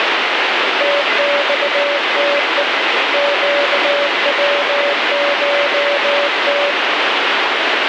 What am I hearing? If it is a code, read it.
Morse code (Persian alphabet), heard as a keyed tone, hand-sent with a bug key, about 19 wpm, 570 Hz, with heavy radio static. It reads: تخته گوشت